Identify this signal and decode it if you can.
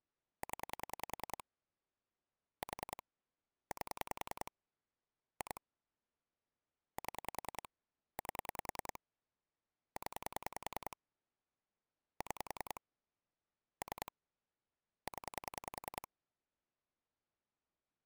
Pulse dialling, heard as clicks on a phone line, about 10 pulses a second. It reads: 0 4 8 2 7 8 0 6 3 0